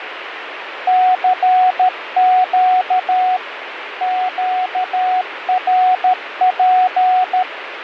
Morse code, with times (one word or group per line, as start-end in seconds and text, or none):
0.9-3.4 CQ
4.0-7.4 QRP